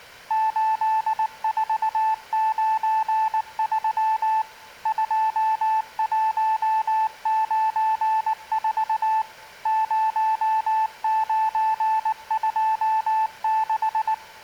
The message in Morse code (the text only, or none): 8493 2194 0926